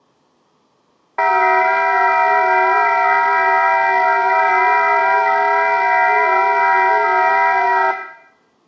FT8 (several signals at once), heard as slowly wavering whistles, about 6.25 baud, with room echo.